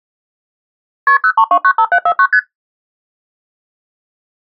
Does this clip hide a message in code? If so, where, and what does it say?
Yes: multi-frequency trunk signalling (R1, as on North American trunks) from 1.1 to 2.4 s, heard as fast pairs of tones, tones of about 70 ms. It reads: KP 03295749 ST